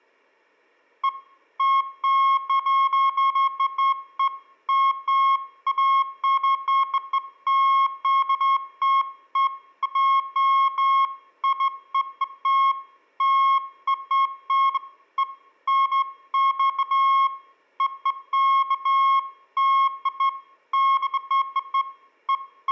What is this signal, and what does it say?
Beeps of irregular length, with room echo. There is no code.